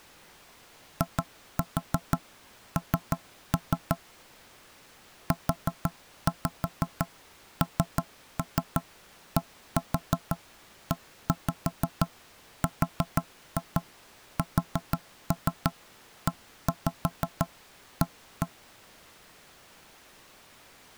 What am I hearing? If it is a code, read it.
Tap code, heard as knocks on wood, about 6 knocks a second. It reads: IN UNDERSEA